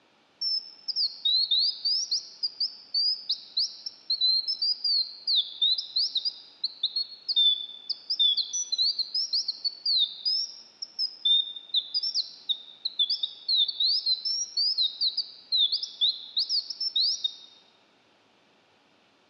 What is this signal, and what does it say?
Bird-like chirps, with room echo. There is no code.